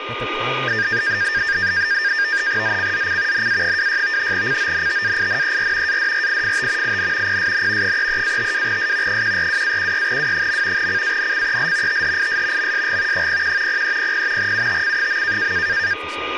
NAVTEX (SITOR-B), 100 baud, 170 Hz shift, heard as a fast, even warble, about 1700 Hz centre, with radio static, a steady whistle near 1220 Hz and speech in English. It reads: ZCZC NA26 CONTAINER ADRIFT IN PSN 33-52S 142-16W. CANCEL THIS MSG 01 0300 UTC.